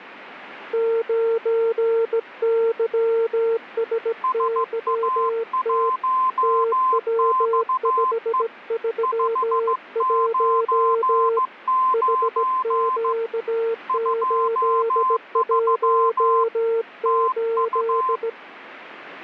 Morse code, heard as two keyed tones. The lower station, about 17 wpm, 460 Hz: 9YSYT TW531 HQ818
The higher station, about 15 wpm, 1040 Hz: SA1XE 599 23 TU